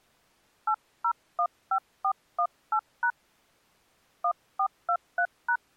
DTMF, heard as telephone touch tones, dialled by hand, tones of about 70 ms. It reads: 8015418# 1423#